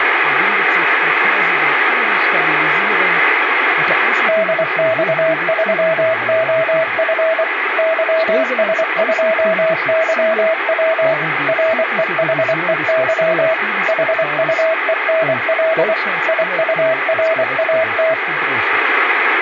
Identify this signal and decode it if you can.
Morse code, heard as a keyed tone, machine-sent, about 24 wpm, 650 Hz, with radio static. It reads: DX3OF YS2YW REHEY HUENL IURAT